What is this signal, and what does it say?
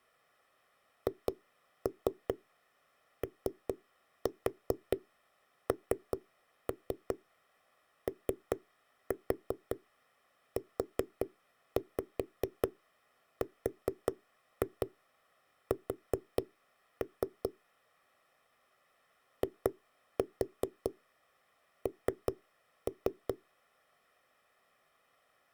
Tap code, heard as knocks on a wall, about 5 knocks a second. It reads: HONOURS IN